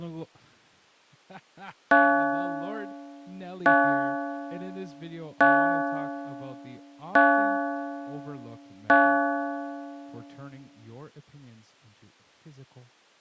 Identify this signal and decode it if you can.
Clock strike, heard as a bell, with speech in English. 5. Five o'clock.